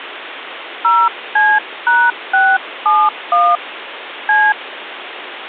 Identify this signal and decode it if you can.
DTMF, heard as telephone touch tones, dialled by hand, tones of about 240 ms, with phone line noise. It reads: 0C#671 C